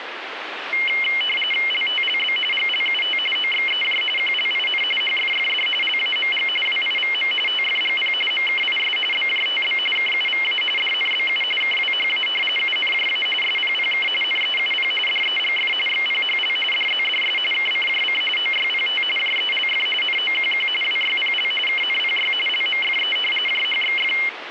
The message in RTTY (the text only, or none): LTLB GLUT OXEJ QLIN HFFD LAMG WIVM TFGP MKIS BJTB KUVA DNBU KWHA UNJA SPPK NEUP DEGF XPHL DZDS KCJC OYPT JELF NOQQ WYPL KNPY LMFE JHXF